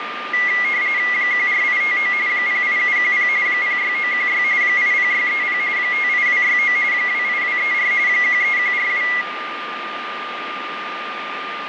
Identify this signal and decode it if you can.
RTTY (45.45 baud, 170 Hz shift), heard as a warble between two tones, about 2050 Hz centre, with radio static and a steady whistle near 1210 Hz. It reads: 14859 08710 06916 80630 58269 28234 13142